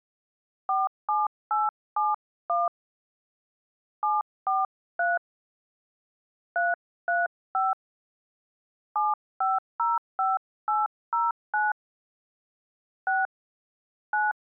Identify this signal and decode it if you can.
DTMF, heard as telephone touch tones, dialled by hand, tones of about 180 ms. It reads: 47871 743 335 7505809 6 9